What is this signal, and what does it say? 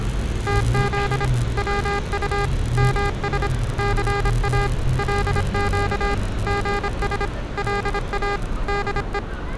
Morse code (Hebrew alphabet), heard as electronic beeps, machine-sent, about 26 wpm, 400 Hz, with street noise. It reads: תז צט מש סא לק גש לא דו